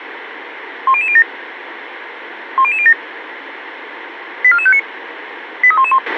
Five-tone selective call (ZVEI), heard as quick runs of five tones, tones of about 70 ms, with radio hiss and a squelch burst at the end. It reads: 10007 10007 84459 83111